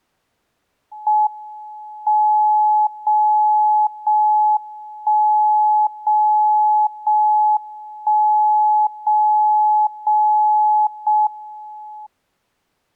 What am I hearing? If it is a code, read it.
Radio time signal (JJY), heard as a tone whose level steps once a second, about 850 Hz. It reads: M 0 0 1 0 0 1 0 0 0 M